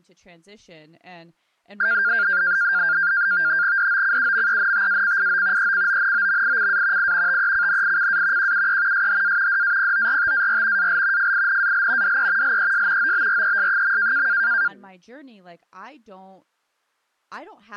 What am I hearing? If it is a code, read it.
NAVTEX (SITOR-B), 100 baud, 170 Hz shift, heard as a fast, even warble, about 1500 Hz centre, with speech in English. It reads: DOCUMENTACIO ECONOMICA I TECNICA QUE SHA DAPORTAR AL FINAL DE LES OBRES.